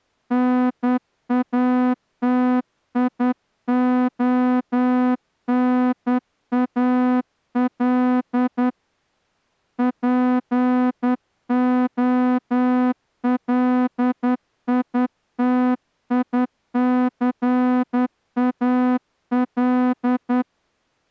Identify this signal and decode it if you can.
Morse code, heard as a horn, hand-sent with a straight key, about 10 wpm. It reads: NATIONAL POLITICAL